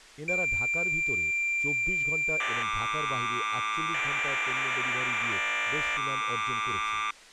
Cassette data (Kansas City type), 1200 baud, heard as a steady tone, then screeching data, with speech in Bangla.